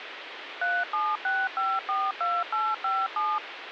DTMF, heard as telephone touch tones, dialled by machine, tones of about 220 ms, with phone line noise. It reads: 376542857